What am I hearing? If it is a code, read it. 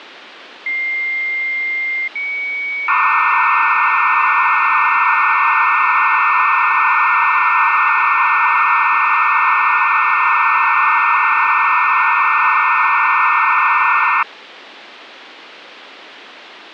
Dial-up modem handshake (low-speed, two carriers), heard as two whistles, then hiss, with phone line noise.